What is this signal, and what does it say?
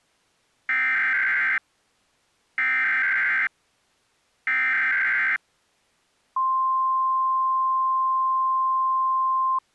Emergency Alert System (SAME) tones (header bursts, then the 1050 Hz attention tone), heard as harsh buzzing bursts, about 520.83 baud.